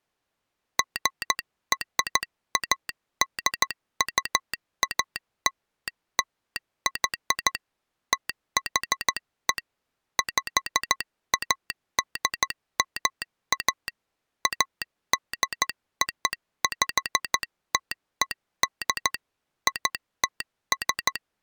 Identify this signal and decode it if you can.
Morse code (American railroad code), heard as a telegraph sounder, hand-sent with a straight key. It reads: GRADUALLY THE PADMA ADOPTED ITS